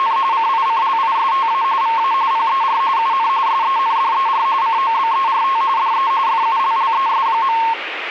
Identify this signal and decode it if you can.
RTTY (45.45 baud, 170 Hz shift), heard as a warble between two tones, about 990 Hz centre, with radio static. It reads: … CICLISTA VA PER UN SENDER COBERT DE FULLES.